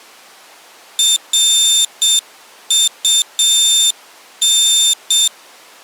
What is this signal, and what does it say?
Morse code, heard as a high beeper, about 7 wpm, 3600 Hz. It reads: RUN